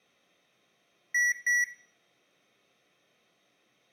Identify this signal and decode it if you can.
Beep code, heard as beeps from a small speaker, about 1950 Hz, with room echo. 2 short. In AMI BIOS tables: memory parity error; in IBM BIOS tables: self-test error shown on screen; in Dell tables: no memory detected.